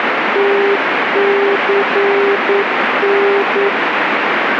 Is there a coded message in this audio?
Yes: Morse code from 0.3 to 3.7 s, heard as a keyed tone, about 9 wpm, 400 Hz, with radio static. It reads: TCN